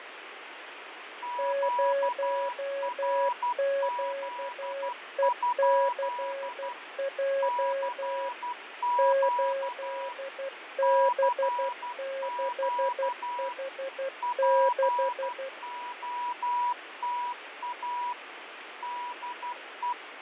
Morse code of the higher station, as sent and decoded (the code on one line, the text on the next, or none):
--.- .-. --.. ..--.. / -.-. --.- / -.-. --.- / .--. --- - .- / -.. .
QRZ? CQ CQ POTA DE